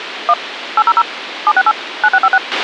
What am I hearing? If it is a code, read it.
DTMF, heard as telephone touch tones, dialled by machine, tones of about 50 ms, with radio hiss and a squelch burst at the end. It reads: 1 800 768 9656